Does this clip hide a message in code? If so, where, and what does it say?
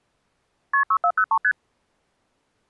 Yes: multi-frequency trunk signalling (R1, as on North American trunks) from 0.7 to 1.5 s, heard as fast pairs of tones, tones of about 70 ms. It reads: KP 6403 ST